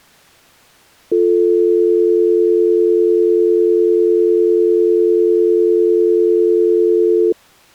Telephone call progress tone (North American or UK plan), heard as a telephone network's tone, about 350, 440 Hz. Dial tone.